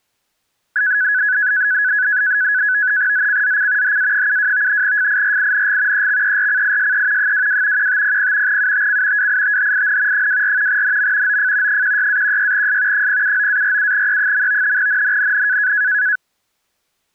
NAVTEX (SITOR-B), 100 baud, 170 Hz shift, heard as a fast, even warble, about 1600 Hz centre. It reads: ZCZC HA72 FIRING EXERCISE 22 1500 UTC WITHIN 24 NM OF 16-16S 079-47E. NNNN